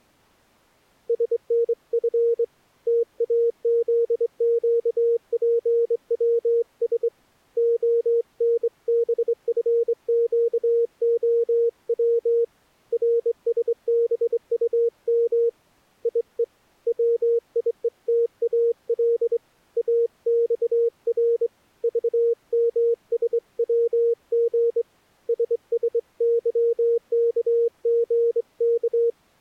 Morse code, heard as a keyed tone, hand-sent with a straight key, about 23 wpm, 470 Hz. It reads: SNF TAZQPWS ONBFQOW RSBUM IE WIETAL AXR VMSWG SSYKGK